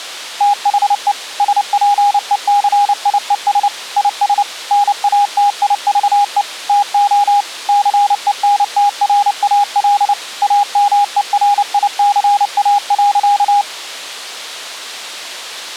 Morse code, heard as a keyed tone, machine-sent, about 29 wpm, 820 Hz. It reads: THE SPECIES IS NATIVE TO CENTRAL AMERICA.